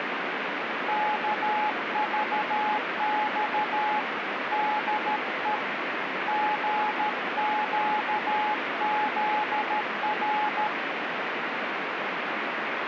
Morse code, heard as a keyed tone, hand-sent with a paddle, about 13 wpm, 850 Hz, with radio static. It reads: KVX DE GQZR